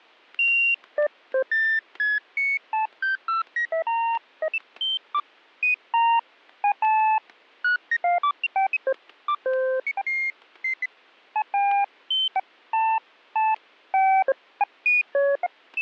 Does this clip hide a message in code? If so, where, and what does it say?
No, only electronic bleeps of random pitch and length, with static crashes.